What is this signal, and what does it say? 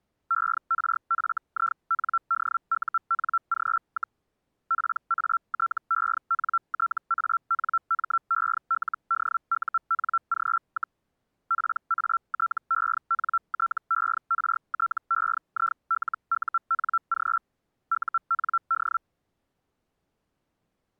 Hellschreiber (Feld-Hell, 122.5 baud), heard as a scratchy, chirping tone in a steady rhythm, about 1350 Hz. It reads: ERFINDUNG, PATENTANMELDUNG, PATENTERTEILUNG UND